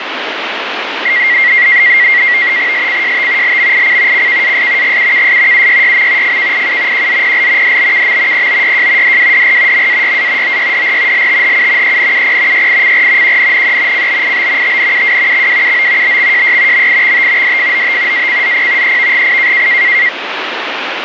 NAVTEX (SITOR-B), 100 baud, 170 Hz shift, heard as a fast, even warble, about 2050 Hz centre, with radio static. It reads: SCJT LMIC CKAS GUKS UYYM FKIU QZPL DBKM POYJ DWDR MAYA OYDR LTHU ENUP YICR QNNE CBIB TNUW XWUO BXJY MIXT DFOT ACZP EVGI